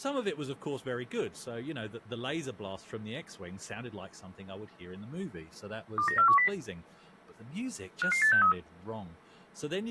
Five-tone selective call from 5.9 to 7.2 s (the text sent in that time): 29410